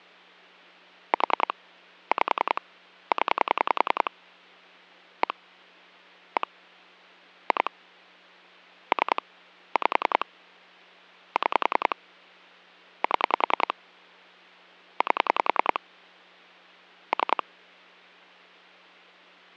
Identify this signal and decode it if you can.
Pulse dialling, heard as clicks on a phone line, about 10 pulses a second, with hum. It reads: 4 5 0 1 1 2 3 5 6 7 8 3